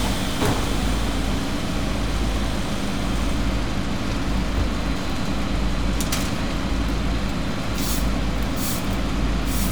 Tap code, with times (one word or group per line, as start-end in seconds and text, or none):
none